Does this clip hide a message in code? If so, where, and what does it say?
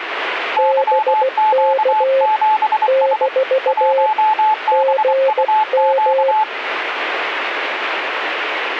Yes: Morse code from 0.5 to 6.5 s, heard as two keyed tones, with radio static. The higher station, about 24 wpm, 860 Hz: YQ7S 1BUQ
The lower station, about 16 wpm, 540 Hz: BK - GM